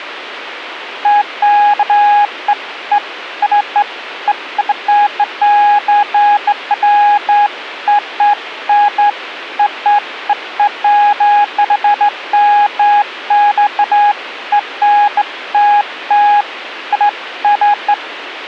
Beeps of irregular length, with radio hiss. There is no code.